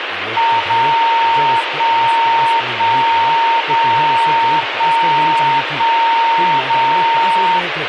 Radio time signal (DCF77), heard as a tone whose level steps once a second, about 920 Hz, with radio static and speech in Urdu. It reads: 0 1 1 0 1 1 0